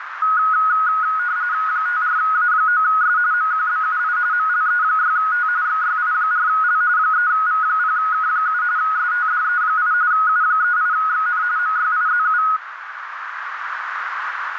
RTTY (45.45 baud, 170 Hz shift), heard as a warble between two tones, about 1360 Hz centre, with radio static and a narrow filter. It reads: 54A9S MQBUI MLE6T XYI4L 3V0K7 STDE8 U38XN MYIZU